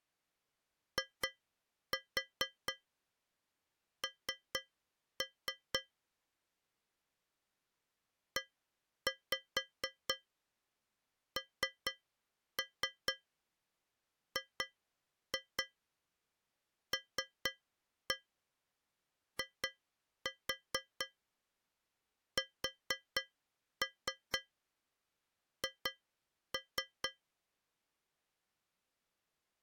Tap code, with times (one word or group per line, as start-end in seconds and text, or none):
1.0-5.8 IN
8.4-27.1 ENGLISH